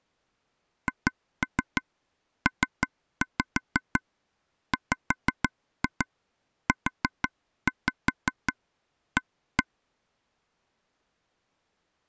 Tap code, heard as taps on a table, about 6 knocks a second. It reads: HPWUA